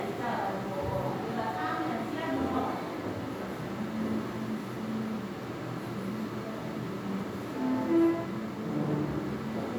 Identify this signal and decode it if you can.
The noise of a crowd indoors. There is no code.